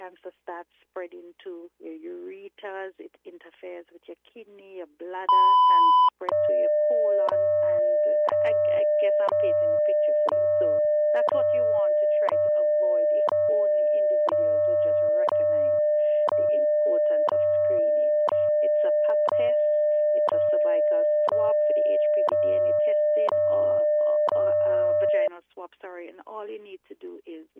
Radio time signal (WWV, Colorado), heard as ticks, one a second.